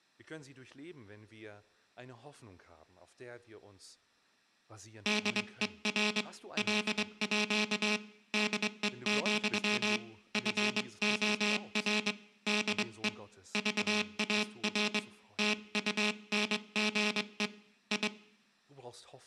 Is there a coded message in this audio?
Yes: Morse code (with Danish letters) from 5.0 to 18.1 s, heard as a buzzer, hand-sent with a straight key, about 23 wpm, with room echo and speech in German. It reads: DER LÅ DE, FOR DE VAR TUNGE I